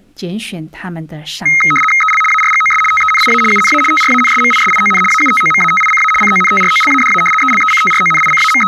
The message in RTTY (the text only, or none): EL ARGOS TENIA UNA TRANSMISION AUTOMATICA CONTROLADA …